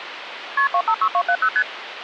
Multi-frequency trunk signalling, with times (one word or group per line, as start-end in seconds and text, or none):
0.6-0.7 KP
0.7-1.5 256270
1.6-1.6 ST